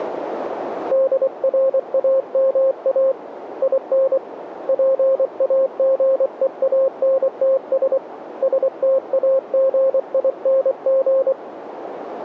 Morse code, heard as a keyed tone, hand-sent with a paddle, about 24 wpm, 530 Hz, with radio static and a narrow filter. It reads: DRAMA IN PAGEANTS STAGING